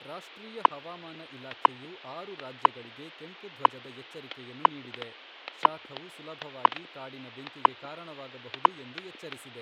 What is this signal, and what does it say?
Radio time signal (WWV, Colorado), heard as ticks, one a second, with static crashes and speech in Kannada.